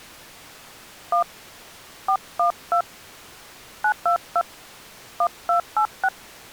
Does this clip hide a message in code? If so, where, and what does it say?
Yes: DTMF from 1.1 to 6.1 s, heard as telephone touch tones, dialled by hand, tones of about 80 ms. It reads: 1 412 922 1286